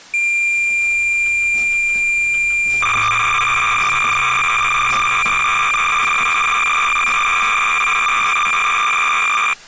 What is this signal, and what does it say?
Cassette data (Kansas City type), 300 baud, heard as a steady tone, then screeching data.